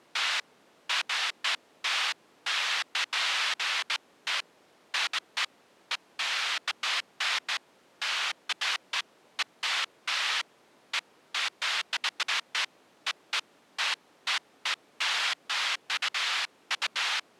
Bursts of noise. There is no code.